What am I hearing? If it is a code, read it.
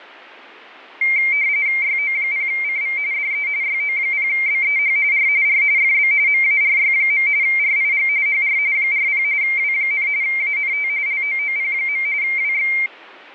RTTY (45.45 baud, 170 Hz shift), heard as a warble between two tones, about 2200 Hz centre. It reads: YO0CV DE YO0BEH R R FB MARY. RIG HR 40 W, ANT LOOP. WX